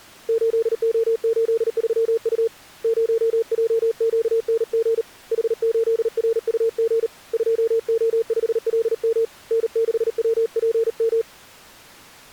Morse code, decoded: 8O83U 0JQNG H8RUG 2O5LM N6WPM

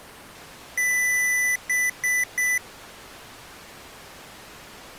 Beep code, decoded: 1 long, 3 short

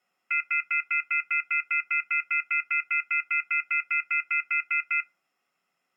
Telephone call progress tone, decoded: off-hook warning tone

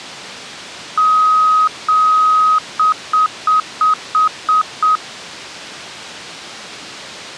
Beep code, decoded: 2 long, 7 short

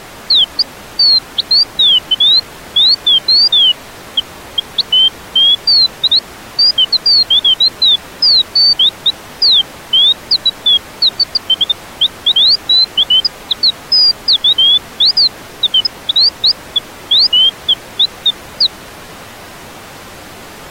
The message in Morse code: none

